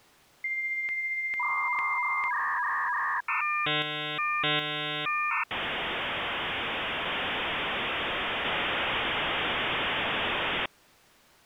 Dial-up modem handshake (V.34 or later), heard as a whistle, warbles, then hiss.